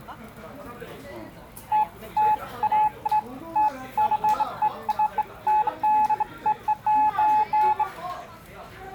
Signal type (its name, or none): none